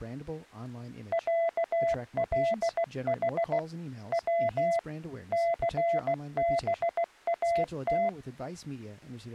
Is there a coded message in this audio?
Yes: Morse code (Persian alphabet) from 1.1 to 8.2 s, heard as a keyed tone, machine-sent, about 16 wpm, 680 Hz, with speech in English. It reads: صلح و ثبات